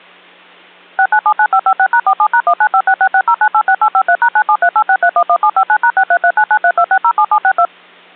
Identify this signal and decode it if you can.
DTMF, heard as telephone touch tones, dialled by machine, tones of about 70 ms. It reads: 6979556#47#1956660986853#97386311759#6339932607762